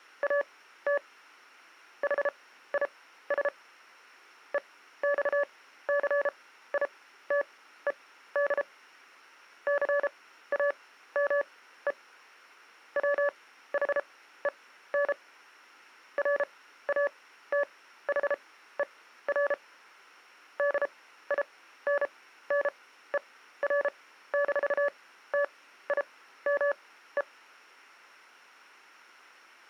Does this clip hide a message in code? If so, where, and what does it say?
Yes: Morse code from 0.2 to 27.3 s, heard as a keyed tone, machine-sent, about 33 wpm, spaced as for 15 wpm, 570 Hz. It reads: AT HIS EXCITED CAME WHEN RATHER DINNER-TIME